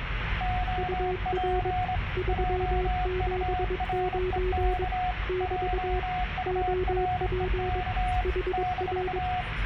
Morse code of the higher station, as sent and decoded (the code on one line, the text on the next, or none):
--- .--. / .--- ..- .-. . -.- / .--- ..- .-. . -.- / -....-
OP JUREK JUREK -